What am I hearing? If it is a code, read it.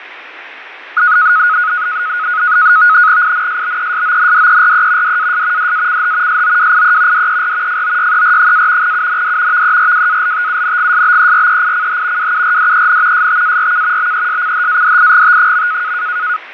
NAVTEX (SITOR-B), 100 baud, 170 Hz shift, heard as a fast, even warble, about 1360 Hz centre, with radio static and fading. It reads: INSBESONDERE DAS DACH SOWIE DER FOYER- UND VERWALTUNGSBEREICH WURDEN STARK BESCHADIGT.